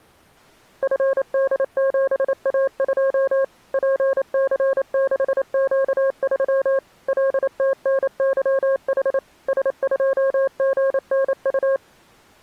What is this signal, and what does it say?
Morse code, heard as a keyed tone, machine-sent, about 28 wpm, 540 Hz. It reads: FD7A2 PC6Q3 LTNYH S2GNU